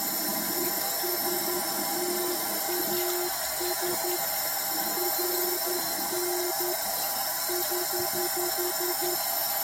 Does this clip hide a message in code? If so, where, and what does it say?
Yes: Morse code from 0.5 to 9.2 s, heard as a keyed tone, hand-sent with a paddle, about 11 wpm, 360 Hz, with the noise of a restroom. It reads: ESTAS RN <HH>